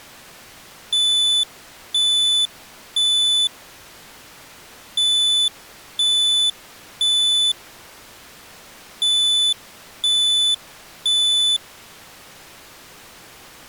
Alarm pattern, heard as an alarm's beeps, played three times, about 3500 Hz. Temporal three. Smoke or fire, evacuate.